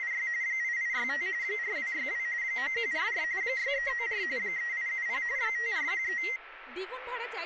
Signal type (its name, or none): RTTY